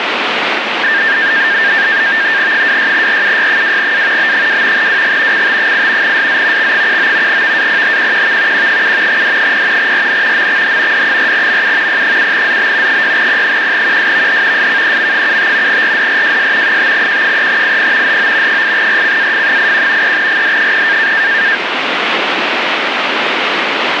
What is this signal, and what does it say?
NAVTEX (SITOR-B), 100 baud, 170 Hz shift, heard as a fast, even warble, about 1700 Hz centre, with radio static. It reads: 26RUY2A B2 WG CT8 SZ X19 VAPHQQV Q7 D0 RN MXH D4MU P7ZB 6P1QSVH SKEM75 RDRJS 5Q3IP HO 8RCAF81 3GD0